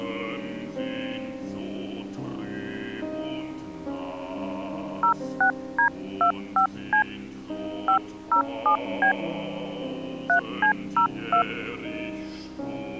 DTMF, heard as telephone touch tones, dialled by hand, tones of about 100 ms. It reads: 06D25C 507B 3C02